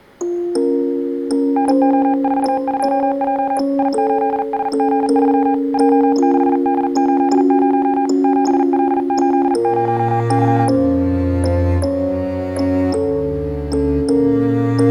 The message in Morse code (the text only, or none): NO42J I8SG3 J6D80 7L80Y